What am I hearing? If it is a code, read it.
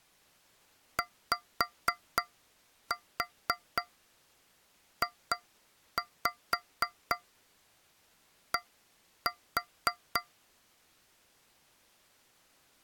Tap code, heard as taps on a metal pipe, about 4 knocks a second. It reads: YJD